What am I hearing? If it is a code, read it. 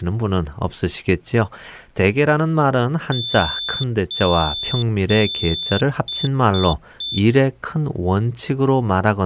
Beep code, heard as a piezo beeper, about 3550 Hz, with speech in Korean. 3 long, 3 short.